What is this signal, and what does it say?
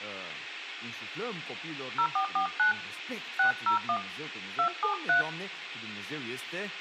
DTMF, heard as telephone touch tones, dialled by hand, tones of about 100 ms, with speech in Romanian. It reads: 0449 601 273